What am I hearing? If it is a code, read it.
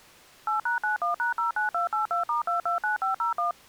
DTMF, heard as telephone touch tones, dialled by machine, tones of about 130 ms. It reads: 8#91#09282*229501